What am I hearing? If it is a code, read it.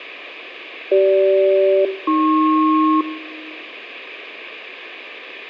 Aircraft SELCAL, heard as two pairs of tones, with room echo. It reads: CG-AP